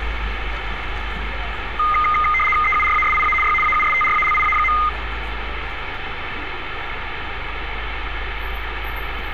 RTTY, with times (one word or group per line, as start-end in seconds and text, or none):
2.6-3.3 EURASIA
3.4-3.5 Y
3.6-4.7 AUSTRALIA.